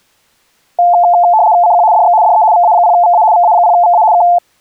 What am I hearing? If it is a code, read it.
RTTY (75 baud, 170 Hz shift), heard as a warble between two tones, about 790 Hz centre. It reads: CQ DX DE VA0VA VA0VA K